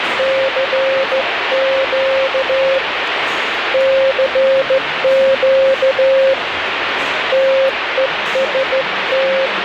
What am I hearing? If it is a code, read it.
Morse code, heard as a keyed tone, hand-sent with a straight key, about 14 wpm, 540 Hz, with radio static and the noise of a restaurant. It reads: CQ CQ TEST